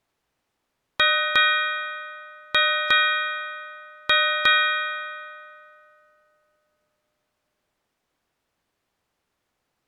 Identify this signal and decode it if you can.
Ship's bell, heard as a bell. 6. Six half-hours of the watch have passed.